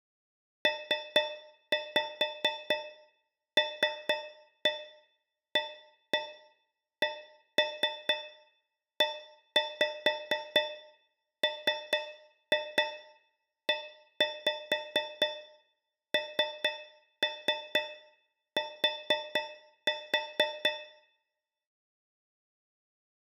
Tap code, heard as taps on a metal pipe, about 4 knocks a second, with room echo. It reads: PLACEMENT